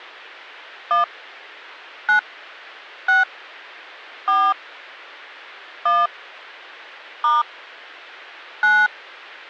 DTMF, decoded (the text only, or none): 1 9 6 4 1 * 9